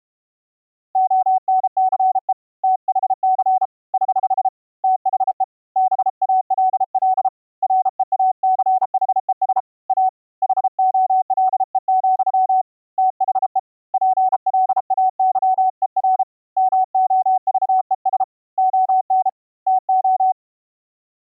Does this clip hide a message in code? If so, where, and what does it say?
Yes: Morse code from 0.9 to 20.4 s, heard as a keyed tone, hand-sent with a paddle, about 33 wpm, 750 Hz. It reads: ONCE THC <HH> THE BALL REACHES A HOLE, THE PLAYER MOVES ON TO